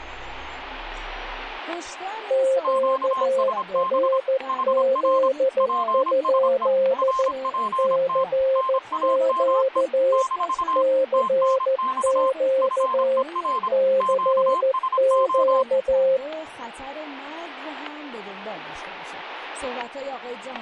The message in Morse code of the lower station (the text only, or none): QRZ? CQ CQ CQ